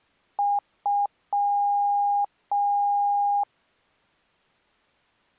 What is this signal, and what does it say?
Beep code, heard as beeps, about 810 Hz. 2 short, 2 long.